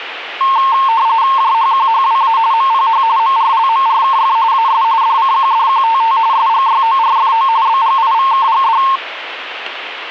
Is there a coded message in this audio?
Yes: RTTY (45.45 baud, 170 Hz shift) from 0.4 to 9.0 s, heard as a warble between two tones, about 990 Hz centre, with radio static. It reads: JHQHWA MPH MRLMRKF AS DCQDQTT SGYORFO BGIVKGD